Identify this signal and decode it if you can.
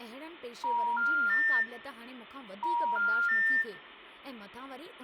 Telephone call progress tone (ITU plan), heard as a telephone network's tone, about 950, 1400, 1800 Hz, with room echo and speech in Sindhi. Special information tone.